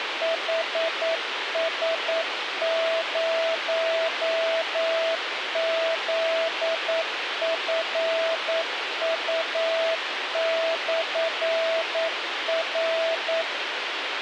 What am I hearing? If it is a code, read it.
Morse code, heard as a keyed tone, machine-sent, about 9 wpm, 660 Hz, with radio hiss. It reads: HS0ZFU/R